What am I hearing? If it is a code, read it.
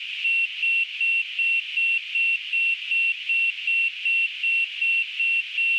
Evenly repeated beeps, with radio static. There is no code.